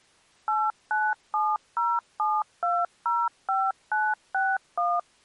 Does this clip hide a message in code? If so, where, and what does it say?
Yes: DTMF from 0.5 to 5.0 s, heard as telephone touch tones, dialled by machine, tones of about 220 ms. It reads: 89707205961